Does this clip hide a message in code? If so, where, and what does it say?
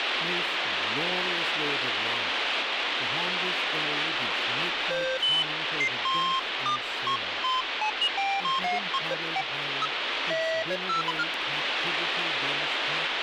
No, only electronic bleeps of random pitch and length, with radio static.